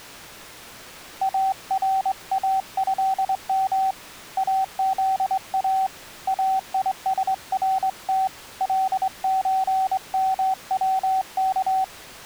Morse code (Arabic alphabet), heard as a keyed tone, hand-sent with a straight key, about 23 wpm, 770 Hz. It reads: اراهم اذا ايسرت لزموك